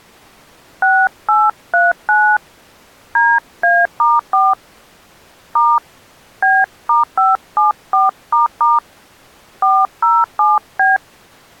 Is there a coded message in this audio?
Yes: DTMF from 0.8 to 11.0 s, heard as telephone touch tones, dialled by hand, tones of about 210 ms. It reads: 6839 DA*4 * B*574** 407B